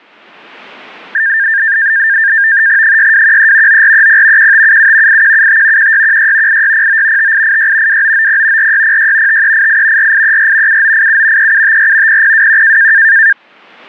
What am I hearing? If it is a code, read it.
NAVTEX (SITOR-B), 100 baud, 170 Hz shift, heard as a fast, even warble, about 1700 Hz centre. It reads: 6213 9430 1577 8175 1616 8609 5886 2990 4606 5388 4834 7987 3754 0021